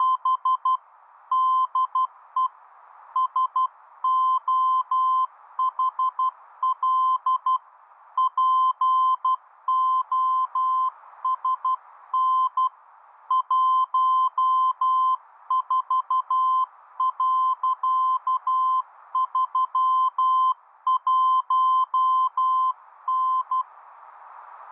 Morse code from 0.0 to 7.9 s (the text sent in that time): … DE SOHL